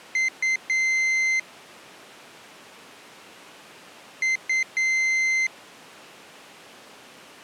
Beep code, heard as a piezo beeper, played twice, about 2050 Hz. 2 short, 1 long.